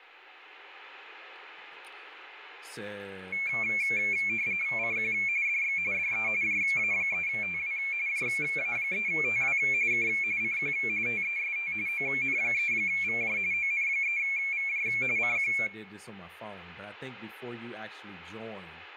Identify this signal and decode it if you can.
RTTY (45.45 baud, 170 Hz shift), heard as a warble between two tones, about 2300 Hz centre, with room echo and speech in English. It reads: CQ DX DE JA3TW JA3TW K CQ TEST ON3VJ ON3VJ CQ